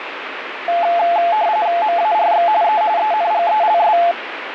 RTTY (45.45 baud, 170 Hz shift), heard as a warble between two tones, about 770 Hz centre, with radio static. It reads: MARX E ENGELS